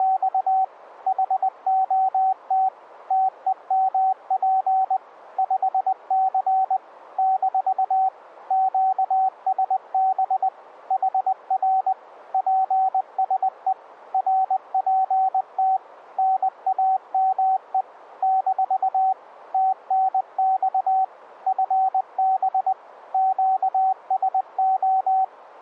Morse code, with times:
0.0-0.6 …
1.1-2.7 HOT
3.1-5.0 TEMP
5.4-6.8 5C
7.2-8.1 -
8.5-10.5 QSB
10.9-11.9 HR
12.3-13.7 PSE
14.1-15.8 RPT
16.2-17.8 NAME
18.2-19.1 -
19.5-21.0 TNX
21.5-22.7 FB
23.1-25.2 QSO

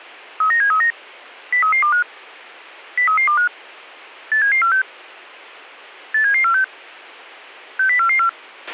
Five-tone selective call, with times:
0.4-0.9 39739
1.5-2.0 03325
3.0-3.5 03325
4.3-4.8 87746
6.1-6.6 87746
7.8-8.3 60444

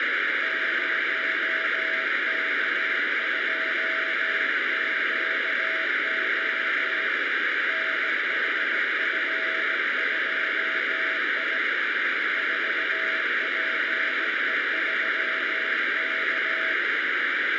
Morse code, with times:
0.4-7.1 0K2QO
7.7-11.6 NHF2I
12.4-16.7 4PE3K

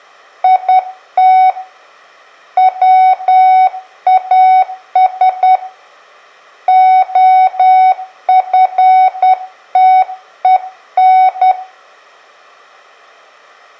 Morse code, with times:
0.4-1.5 IT
2.6-5.6 WAS
6.7-11.5 OFTEN

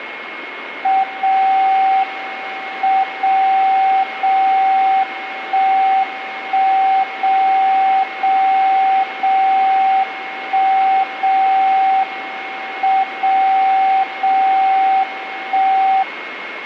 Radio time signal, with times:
1.0-2.0 0
2.0-3.0 M
3.0-4.0 0
4.0-5.0 0
5.0-6.0 1
6.0-7.0 1
7.0-8.0 0
8.0-9.0 0
9.0-10.0 0
10.0-11.0 1
11.0-12.0 0
12.0-13.0 M
13.0-14.0 0
14.0-15.0 0
15.0-16.0 1

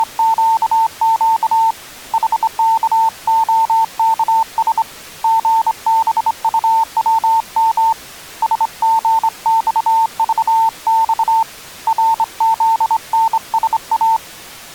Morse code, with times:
0.0-1.7 …
2.1-4.8 HKOKS
5.2-7.9 GBUWM
8.4-11.4 SGXVX
11.9-14.2 RZNSA

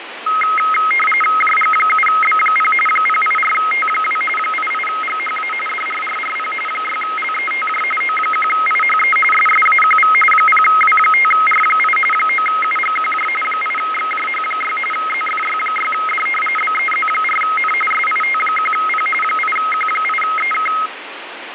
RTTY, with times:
1.4-2.7 JG7B0
2.9-4.2 084T2
4.4-5.5 88GHA
5.7-6.5 DRRRP
6.7-7.8 6LETJ
8.0-9.2 O1IHE
9.3-10.1 SSAQV
10.3-12.0 0W5R8
12.1-13.3 9UGQJ
13.4-14.8 8XJH6
14.9-16.3 ZFY6D
16.6-17.7 BEZ4N
17.9-19.1 SIT1P
19.2-20.7 8Q8EK

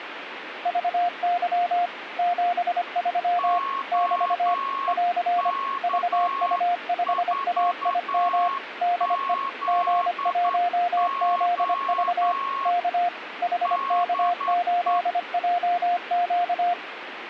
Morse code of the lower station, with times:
0.7-1.9 VY
2.2-3.6 73
3.9-4.5 <BT>
4.9-5.5 <AR>
5.8-8.5 VU5AIM
8.8-9.3 DE
9.7-12.3 G1ZV
12.7-13.1 K
13.4-16.7 HK8JQ

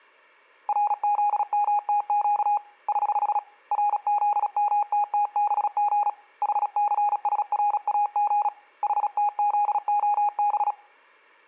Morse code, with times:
0.7-2.6 RZMTQ
2.9-3.4 <HH>
3.7-6.1 RZMTTBG
6.4-8.5 HCSRAG
8.8-10.7 HTZOB

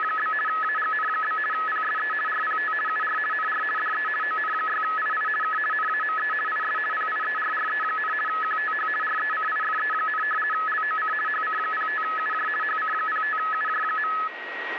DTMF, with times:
none

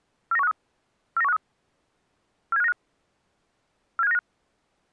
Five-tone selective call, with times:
0.3-0.5 49153
1.2-1.4 49153
2.5-2.7 47595
4.0-4.2 47595

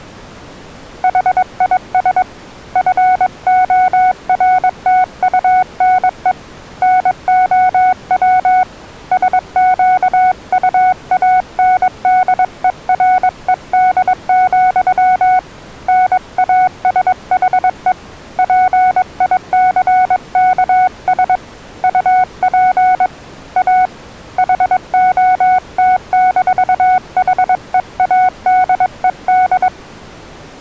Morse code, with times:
1.0-2.2 HIS
2.8-6.3 FORTUNE
6.8-8.6 NOW
9.1-15.4 SQUANDERED,
15.9-17.9 NASHE
18.4-21.4 PICKS
21.8-23.1 UP
23.6-23.9 A
24.4-29.7 HOT-HEADED

